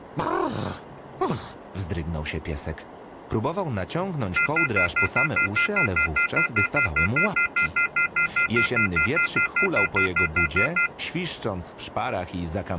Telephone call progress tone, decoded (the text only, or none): off-hook warning tone